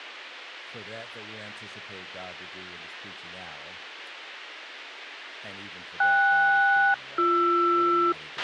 Aircraft SELCAL, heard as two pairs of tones, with a squelch burst at the end. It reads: KS-BR